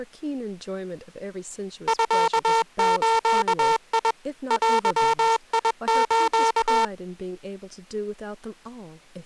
Morse code (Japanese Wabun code), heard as a buzzer, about 21 wpm, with speech in English. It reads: ミズ デス